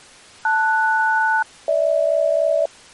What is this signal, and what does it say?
Aircraft SELCAL, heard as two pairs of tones. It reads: LS-GH